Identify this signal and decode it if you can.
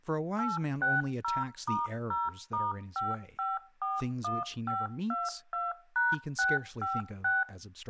DTMF, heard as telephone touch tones, dialled by machine, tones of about 190 ms, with speech in English. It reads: 860*0*5541522#656